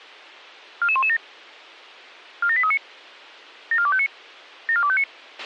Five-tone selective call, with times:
0.8-1.2 44117
2.4-2.8 47839
3.7-4.1 74259
4.7-5.0 74259

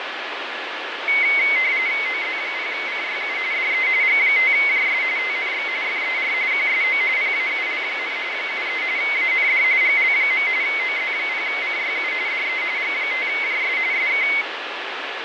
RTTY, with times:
2.1-3.4 OZ0CYU
3.5-3.9 DE
4.0-5.0 G5JS
5.2-5.7 TNX
5.8-6.3 FER
6.5-7.0 QSO
7.2-8.2 PAUL,
8.3-8.8 73
9.0-9.6 AND
9.8-10.5 GL.
10.6-12.1 OZ0CYU
12.3-12.6 DE
12.8-13.8 G5JS
13.9-14.3 SK

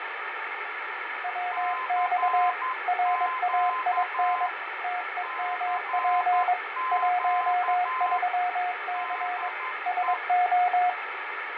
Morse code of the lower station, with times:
1.2-2.5 WX
2.9-4.5 RAIN
4.8-6.5 TEMP
6.9-9.5 13C
9.9-10.9 SO

